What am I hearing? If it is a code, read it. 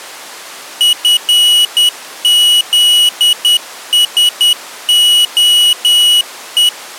Morse code, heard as a high beeper, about 10 wpm, 2950 Hz. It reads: FZSOE